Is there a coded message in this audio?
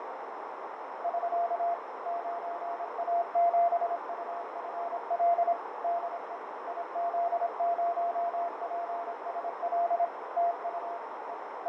Yes: Morse code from 1.0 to 11.7 s, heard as a keyed tone, machine-sent, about 26 wpm, 690 Hz, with heavy radio static, fading and a narrow filter. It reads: <SK> 9A7UFL DE IZ0PSL TU E …